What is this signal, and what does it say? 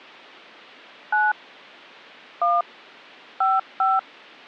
DTMF, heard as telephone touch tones, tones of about 190 ms. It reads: 9 1 55